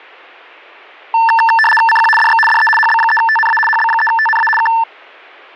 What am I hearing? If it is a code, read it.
RTTY (75 baud, 850 Hz shift), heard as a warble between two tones, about 1330 Hz centre. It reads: CQ DX DE HB3TNA HB3TNA K